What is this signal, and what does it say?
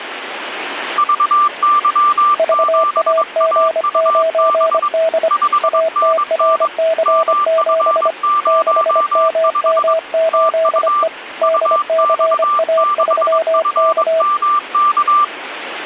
Morse code, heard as two keyed tones, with radio static. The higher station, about 22 wpm, 1180 Hz: VY7AUB 5NN MF05 TU UX6FMK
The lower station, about 25 wpm, 650 Hz: VAG9D ATRC7 6MM8E DCA3K